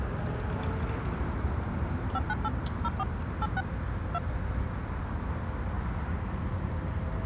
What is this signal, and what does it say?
DTMF, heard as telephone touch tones, dialled by machine, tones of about 40 ms, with street noise. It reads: 598 04 86 2